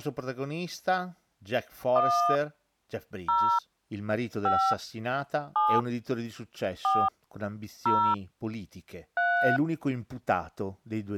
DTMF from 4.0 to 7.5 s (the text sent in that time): 5 7 4